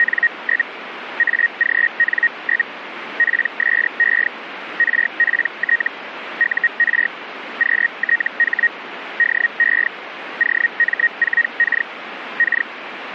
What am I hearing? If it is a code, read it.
Hellschreiber (Feld-Hell, 122.5 baud), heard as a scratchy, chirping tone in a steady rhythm, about 1900 Hz, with radio static. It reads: … AGN? PSE RPT UR QTH DE OM4K K